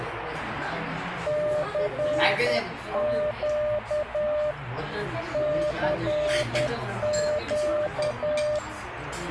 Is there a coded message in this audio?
Yes: Morse code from 1.2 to 8.6 s, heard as a keyed tone, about 10 wpm, 600 Hz, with radio static and the noise of a crowd indoors. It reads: CQ CQ